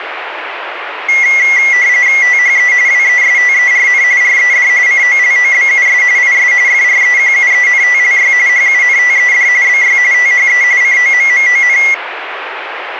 RTTY (45.45 baud, 170 Hz shift), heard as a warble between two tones, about 2050 Hz centre, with radio static. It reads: THE WESTERN RED COLOBUS IS FREQUENTLY HUNTED BY THE COMMON